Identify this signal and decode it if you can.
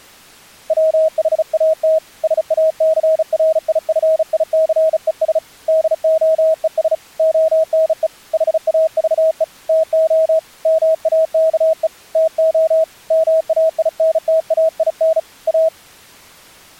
Morse code, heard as a keyed tone, hand-sent with a bug key, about 35 wpm, 640 Hz. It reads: WHAT SACRIFICES DOES ONE HAVE TO MAKE TO MAINTAIN A